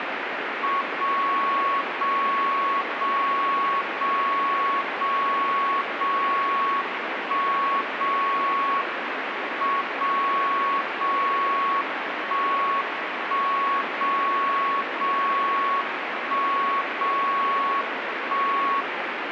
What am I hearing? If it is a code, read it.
Radio time signal (WWVB), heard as a tone whose level steps once a second, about 1110 Hz, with radio static. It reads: 0 0 0 0 0 0 1 0 M 0 0 1 1 0 0 1 0 1